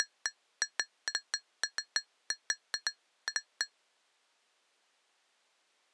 Irregular taps on glass. There is no code.